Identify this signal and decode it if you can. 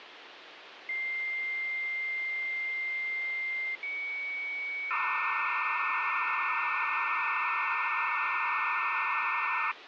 Dial-up modem handshake (low-speed, two carriers), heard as two whistles, then hiss, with phone line noise.